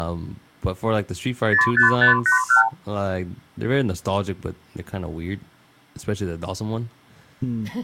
Multi-frequency trunk signalling (R2, with the far end's replies), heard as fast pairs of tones, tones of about 120 ms, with speech in English. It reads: 05581